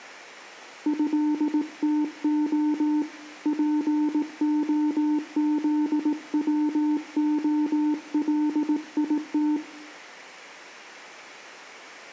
Morse code (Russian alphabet), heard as a keyed tone, hand-sent with a paddle, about 18 wpm, 300 Hz, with room echo. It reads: ЭТО ПОЗВОЛИТ